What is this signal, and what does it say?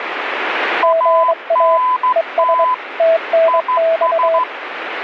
Morse code, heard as two keyed tones, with radio static. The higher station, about 13 wpm, 1010 Hz: ANT IS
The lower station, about 23 wpm, 660 Hz: GA ES TNX